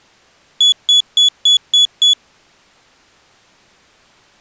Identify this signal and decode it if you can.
Beep code, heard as a piezo beeper, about 3400 Hz. 6 short. In AMI BIOS tables: keyboard controller gate A20 failure; in Dell tables: video card failure.